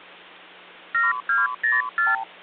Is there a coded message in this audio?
Yes: multi-frequency trunk signalling (R2, with the far end's replies) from 0.9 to 2.2 s, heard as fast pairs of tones, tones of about 170 ms, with hum. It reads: 7204